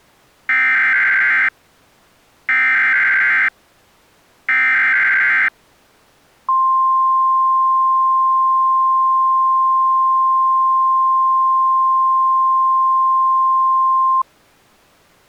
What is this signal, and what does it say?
Emergency Alert System (SAME) tones (header bursts, then the 1050 Hz attention tone), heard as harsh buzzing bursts, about 520.83 baud.